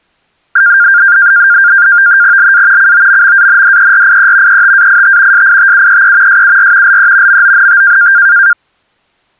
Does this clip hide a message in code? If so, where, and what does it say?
Yes: NAVTEX (SITOR-B), 100 baud, 170 Hz shift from 0.6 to 8.5 s, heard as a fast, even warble, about 1500 Hz centre. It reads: LA COMMANDERIE ETAIT SITUEE SUR LE MONT